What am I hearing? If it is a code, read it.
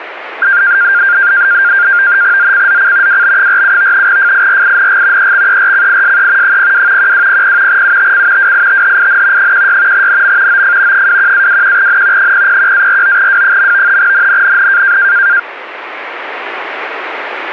NAVTEX (SITOR-B), 100 baud, 170 Hz shift, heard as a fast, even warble, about 1500 Hz centre, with radio static. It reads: ZCZC WB47 FIRING EXERCISE 02 1200 UTC WITHIN 16 NM OF 21-21N 001-49W. NNNN